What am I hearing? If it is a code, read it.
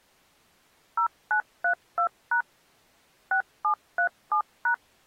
DTMF, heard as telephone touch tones, dialled by machine, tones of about 90 ms. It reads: 0932# 6737#